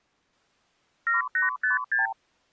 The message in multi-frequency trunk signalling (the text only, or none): 7856